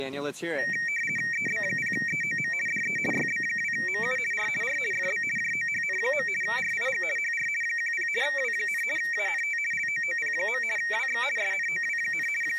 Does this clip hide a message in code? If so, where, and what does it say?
Yes: RTTY (50 baud, 450 Hz shift) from 0.6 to 12.6 s, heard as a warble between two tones, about 2100 Hz centre. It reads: EB0EOM DE YB2MU R R FB JOHN. RIG HR 10 W, ANT LOOP. WX SNOW, …